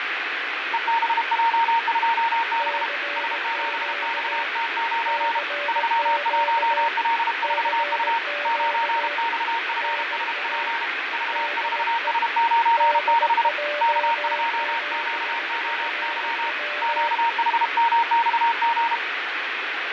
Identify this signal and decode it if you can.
Morse code, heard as two keyed tones, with radio static and fading. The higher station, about 32 wpm, 920 Hz: EBJ2B S7XT9 31L4U 9XFSP V4S96 K2QOY QHMXG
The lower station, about 18 wpm, 580 Hz: CQ CQ CQ NA DE DJ7FW